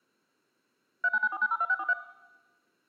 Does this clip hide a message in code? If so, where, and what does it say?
Yes: DTMF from 1.0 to 1.9 s, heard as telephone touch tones, dialled by machine, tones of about 50 ms. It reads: 3994902643